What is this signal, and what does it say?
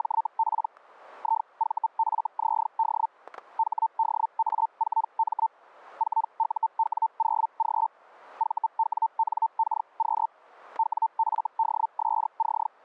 Hellschreiber (Feld-Hell, 122.5 baud), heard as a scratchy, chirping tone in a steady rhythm, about 900 Hz, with static crashes. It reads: … IVFZD HDA4M 4UW0G VWNKQ WFDSC